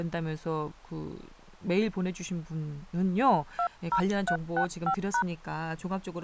DTMF, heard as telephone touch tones, dialled by hand, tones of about 80 ms, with speech in Korean. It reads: 20365#